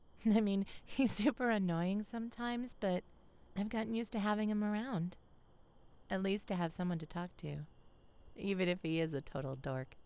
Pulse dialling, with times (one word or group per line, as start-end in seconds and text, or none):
none